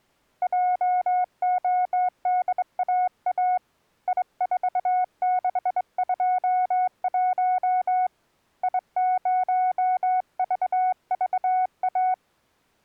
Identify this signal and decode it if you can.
Morse code, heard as a keyed tone, hand-sent with a straight key, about 22 wpm, 730 Hz. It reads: JODAA I4621 I0VVA